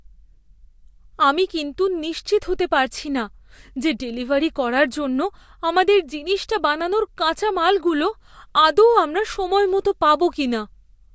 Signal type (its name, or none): none